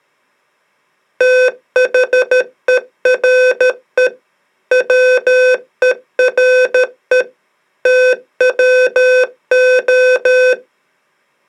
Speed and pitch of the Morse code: 13 wpm, 510 Hz

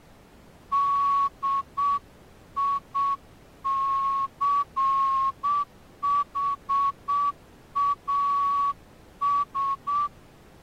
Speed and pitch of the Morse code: 7 wpm

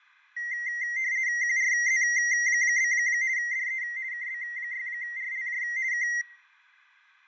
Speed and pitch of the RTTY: 50 baud, 170 Hz shift, 2000 Hz centre

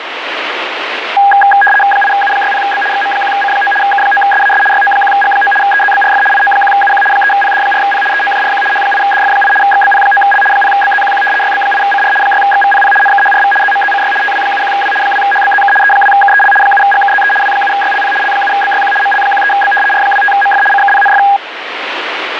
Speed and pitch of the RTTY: 75 baud, 850 Hz shift, 1220 Hz centre

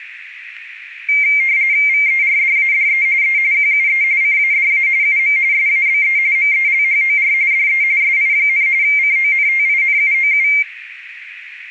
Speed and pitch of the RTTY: 45.45 baud, 170 Hz shift, 2200 Hz centre

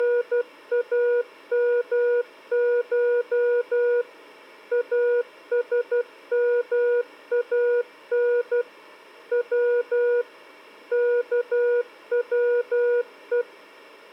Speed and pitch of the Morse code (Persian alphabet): 12 wpm, 480 Hz

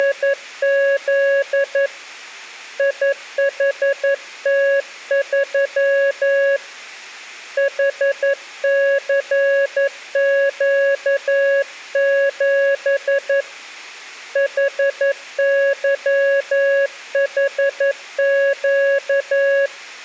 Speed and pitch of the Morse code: 11 wpm, 560 Hz

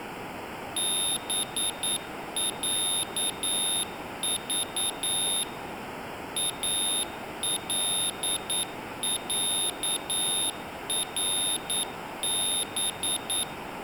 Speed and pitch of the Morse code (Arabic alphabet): 9 wpm, 3650 Hz

